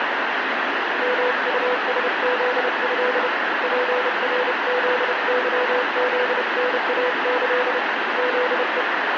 Morse code (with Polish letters), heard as a keyed tone, hand-sent with a paddle, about 30 wpm, 500 Hz, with heavy radio static. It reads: MUSZĘ PRZYZNAĆ ZE